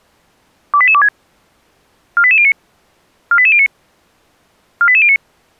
Five-tone selective call (ZVEI), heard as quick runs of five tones, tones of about 70 ms. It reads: 28826 48809 48809 48809